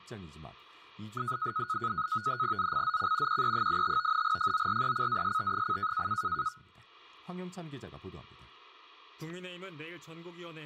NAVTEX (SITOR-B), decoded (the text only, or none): ZCZC QE85 FORECAST: